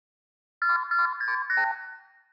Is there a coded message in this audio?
Yes: multi-frequency trunk signalling (R2, with the far end's replies) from 0.6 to 1.7 s, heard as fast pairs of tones, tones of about 150 ms, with room echo. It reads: 4468